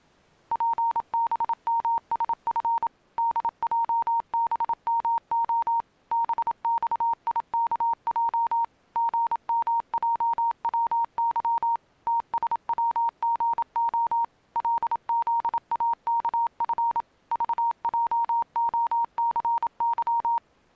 Morse code, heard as a keyed tone, machine-sent, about 27 wpm, 930 Hz. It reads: PBMSF DJBMO BXIKJ GMJWY TSWGO LZAKF VJOCY